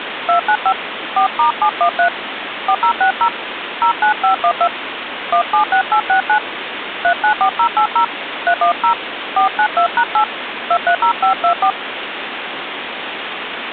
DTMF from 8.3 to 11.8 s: 310 492#8 230524

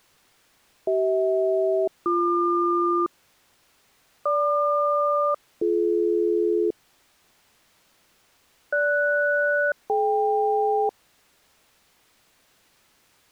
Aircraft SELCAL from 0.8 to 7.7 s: CH-BQ GQ-BD

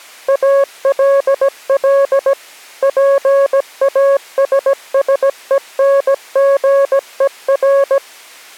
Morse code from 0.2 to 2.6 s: ALL

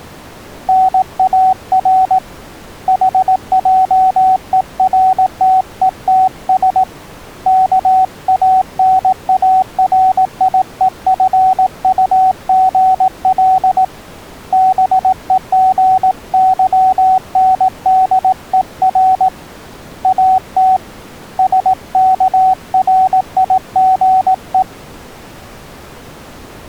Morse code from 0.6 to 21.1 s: NAR HJERTETS KANARIEFUGL BEGYNDER AT

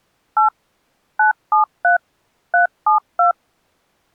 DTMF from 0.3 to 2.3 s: 8 973

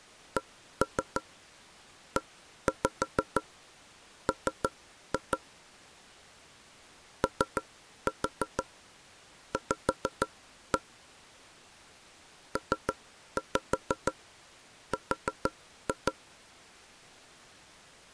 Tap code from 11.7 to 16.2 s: PR

